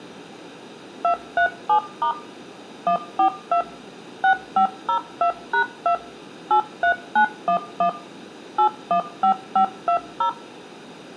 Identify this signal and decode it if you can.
DTMF, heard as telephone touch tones, dialled by machine, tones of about 90 ms, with room echo. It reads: 237* 142 6502#2 83911 815520